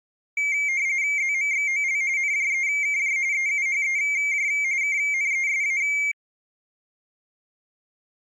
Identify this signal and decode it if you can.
RTTY (45.45 baud, 170 Hz shift), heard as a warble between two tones, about 2200 Hz centre. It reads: ZMXOL NJEKJ EUHEJ KNESA